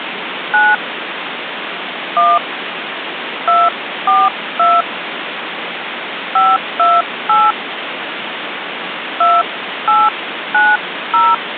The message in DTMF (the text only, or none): 9 1 242 528 2890